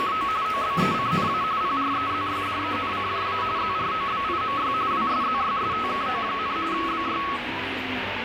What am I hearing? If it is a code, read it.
RTTY (45.45 baud, 170 Hz shift), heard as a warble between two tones, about 1200 Hz centre, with radio static and the noise of a crowd indoors. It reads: … OBECNA PREZYDENCJA ZROBIMY WSZYSTKO, BY